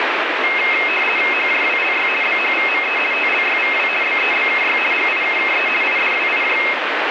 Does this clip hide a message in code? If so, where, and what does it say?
Yes: RTTY (50 baud, 450 Hz shift) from 0.4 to 6.7 s, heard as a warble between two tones, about 2350 Hz centre, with radio static. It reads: HJWLY BHVME TLYVW BEBKY GIKKE IDWIJ